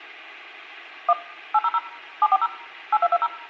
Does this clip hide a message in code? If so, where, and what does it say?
Yes: DTMF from 1.1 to 3.3 s, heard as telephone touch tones, dialled by machine, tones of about 40 ms, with room echo. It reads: 1 800 740 8220